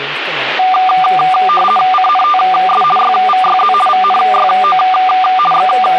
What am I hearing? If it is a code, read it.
RTTY (50 baud, 450 Hz shift), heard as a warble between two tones, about 970 Hz centre, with radio static and speech in Sindhi. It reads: CNTS YVYZ VNYO …